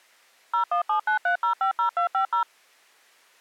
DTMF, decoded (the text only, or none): 01793050250